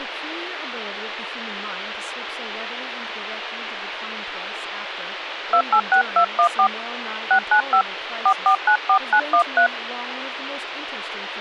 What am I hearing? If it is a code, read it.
DTMF, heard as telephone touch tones, dialled by hand, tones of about 90 ms, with phone line noise and speech in English. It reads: 286214 695 4494913